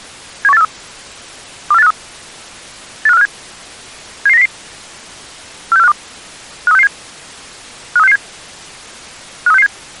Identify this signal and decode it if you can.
Five-tone selective call (EEA), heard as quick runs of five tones, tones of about 40 ms. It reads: 71843 24853 85457 77900 46452 53667 53667 53667